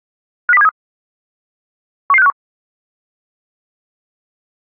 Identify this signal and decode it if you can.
Five-tone selective call (EEA), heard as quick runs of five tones, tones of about 40 ms. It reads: 50273 11651